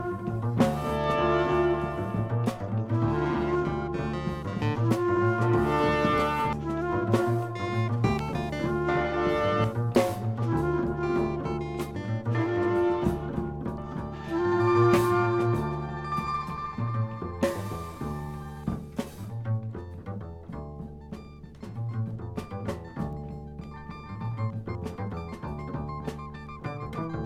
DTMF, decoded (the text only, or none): none